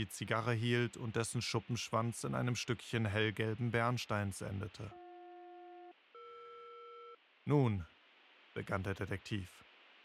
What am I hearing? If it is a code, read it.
Aircraft SELCAL, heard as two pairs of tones, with radio static. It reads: BJ-ER